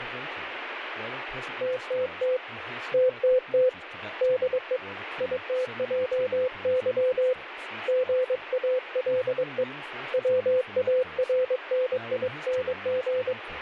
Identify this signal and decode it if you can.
Morse code, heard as a keyed tone, hand-sent with a paddle, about 22 wpm, 510 Hz, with radio static and speech in English. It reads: TTT TTT DE ITJY GALE WARNING